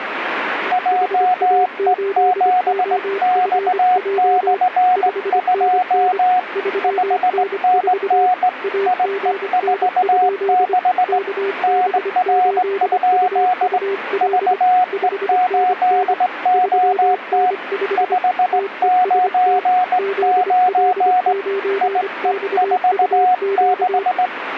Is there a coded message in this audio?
Yes: Morse code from 0.7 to 24.3 s, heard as two keyed tones, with radio static. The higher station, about 18 wpm, 730 Hz: JE7X/2 5NN IE46 NR? VE8OT 599 IE46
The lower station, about 25 wpm, 400 Hz: HA8OFJ 5NN 3N4 AGN? KB8UUL 5NN 3N5 TEST ZL9XUQ